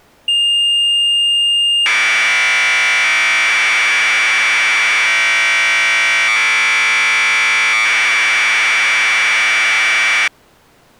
Commodore tape loading (standard loader), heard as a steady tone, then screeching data.